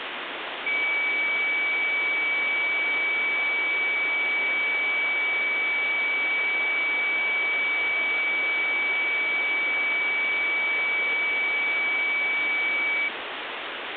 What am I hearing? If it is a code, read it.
A steady tone, with phone line noise. There is no code.